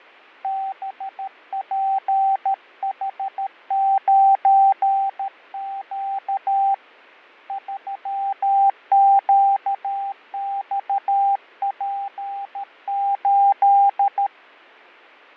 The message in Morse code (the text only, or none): BPH9Q 3QXP8